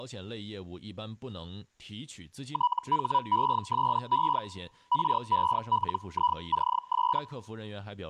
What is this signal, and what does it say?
Hellschreiber (Feld-Hell, 122.5 baud), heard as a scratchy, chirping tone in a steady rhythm, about 980 Hz, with speech in Chinese. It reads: THESE RELICS